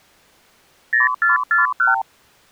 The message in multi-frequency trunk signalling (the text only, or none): 0441